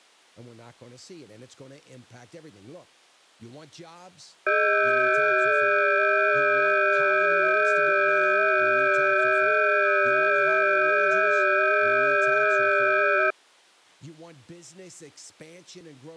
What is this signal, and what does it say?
FT8 (several signals at once), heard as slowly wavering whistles, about 6.25 baud, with speech in English.